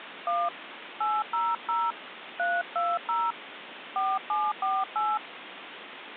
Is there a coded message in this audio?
Yes: DTMF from 0.3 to 5.2 s, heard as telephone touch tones, dialled by hand, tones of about 220 ms, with phone line noise. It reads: 1 800 320 4748